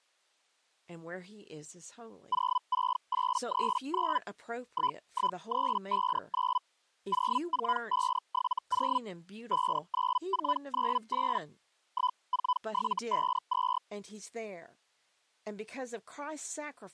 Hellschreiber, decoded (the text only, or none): 06839 11359 04570 59498 14752